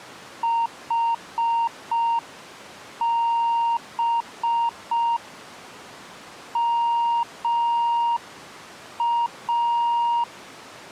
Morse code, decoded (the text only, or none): HB MA